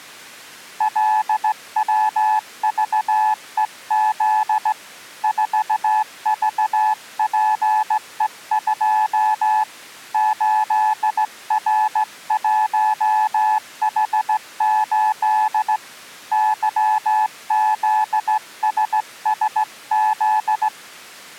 Morse code, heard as a keyed tone, hand-sent with a straight key, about 16 wpm, 860 Hz. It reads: LWVEZ 4VPE2 8R1H8 YZSSZ